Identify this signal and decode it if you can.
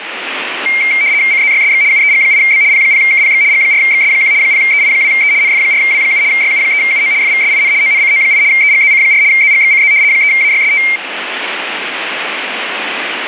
RTTY (75 baud, 170 Hz shift), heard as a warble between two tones, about 2200 Hz centre, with radio static. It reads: CZYSX UEG8B P0KPX G4XS1 0EI2E NF4W7 YU3UO FVSIN ONCO8 EGZC4 ZGXCZ 3AYST